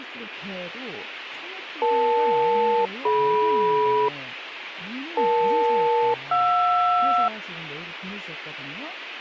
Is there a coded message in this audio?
Yes: aircraft SELCAL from 1.8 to 7.3 s, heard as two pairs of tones, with radio hiss and speech in Korean. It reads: EL-DM EL-JR